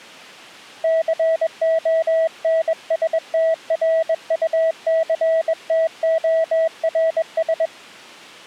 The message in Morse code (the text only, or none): CONSTRUCTORS